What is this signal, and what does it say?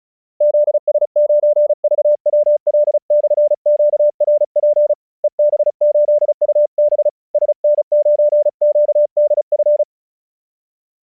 Morse code, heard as a keyed tone, hand-sent with a paddle, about 35 wpm, 590 Hz. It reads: ZS9VWL/QRP EB8UB SN9QDF